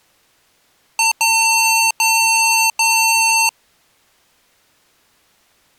Beep code, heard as beeps from a small speaker, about 900 Hz. 1 short, 3 long.